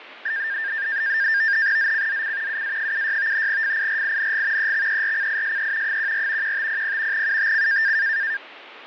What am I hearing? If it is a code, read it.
NAVTEX (SITOR-B), 100 baud, 170 Hz shift, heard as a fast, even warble, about 1700 Hz centre, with radio static. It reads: ZCZC UA76 FIRING EXERCISE 14 1500 UTC